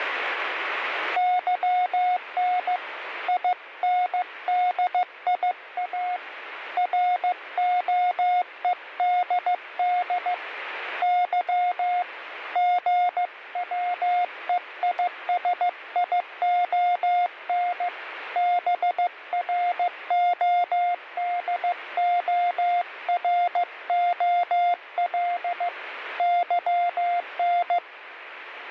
Morse code, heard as a keyed tone, hand-sent with a paddle, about 15 wpm, 710 Hz, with radio static. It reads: YN INDIA ROEDD Y GWEISION BRODOROL YN